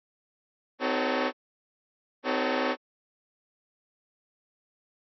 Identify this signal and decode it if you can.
Train horn signal, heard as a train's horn. 2 short. On North American railways: a signal is acknowledged.